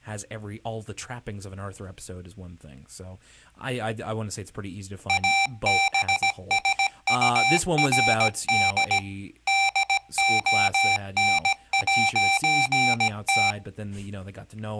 Morse code, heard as electronic beeps, machine-sent, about 17 wpm, 780 Hz, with speech in English. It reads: ABSURD DON'T